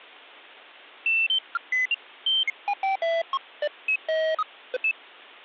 Electronic bleeps of random pitch and length. There is no code.